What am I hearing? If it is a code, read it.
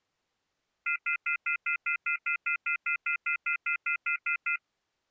Telephone call progress tone (North American plan), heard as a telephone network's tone, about 1400, 2050, 2450, 2600 Hz, 0.1 s on and 0.1 s off. Off-hook warning tone.